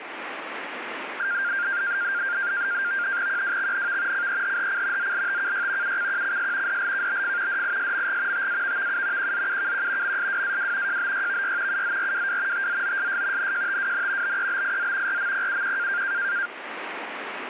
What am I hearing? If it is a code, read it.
NAVTEX (SITOR-B), 100 baud, 170 Hz shift, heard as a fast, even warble, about 1500 Hz centre, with radio static. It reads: QWXNV CEHHC ZLTKY UCQCS DLKBF DISMG TAVVU QZUKQ MSWAW JBYVY UZRWW TZOSS NJTWN BEBIZ RMPUQ